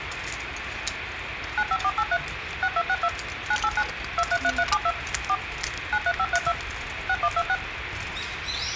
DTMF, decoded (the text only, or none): 95483 6262 989 233372 4 93532 6126